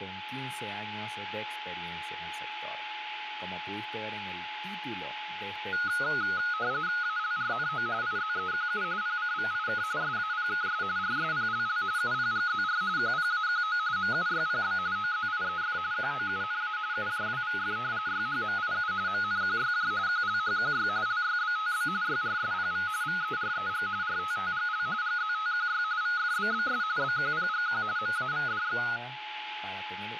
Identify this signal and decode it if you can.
RTTY (45.45 baud, 170 Hz shift), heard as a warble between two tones, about 1360 Hz centre, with radio static, a steady whistle near 850 Hz and speech in Spanish. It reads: ALRNO IZEQU PCVIK SAPKS RSPLL UPGZR QPAQO MUYPB OZIEF QOUNA UJWVF YHMIU MNQYJ QLHQY LYBTB YRSPV VEREG RTTGL GZTQY VFBBS BQPGQ MAVDX